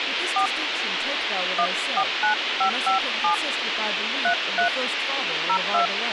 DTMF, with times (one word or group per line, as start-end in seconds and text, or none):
0.4-0.5 4
1.6-3.3 149557
4.2-4.7 33
5.5-5.9 02